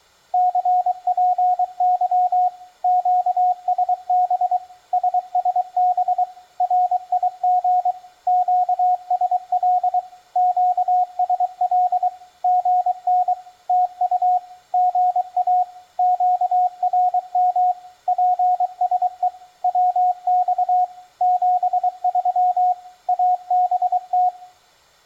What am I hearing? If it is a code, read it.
Morse code, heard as a keyed tone, machine-sent, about 23 wpm, 730 Hz, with room echo. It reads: CPY QSB SSB RIG QSL QSL GN TU GA QRM PSE WX 73 ABT